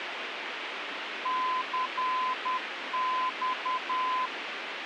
Morse code, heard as a keyed tone, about 10 wpm, 1020 Hz, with radio hiss. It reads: CX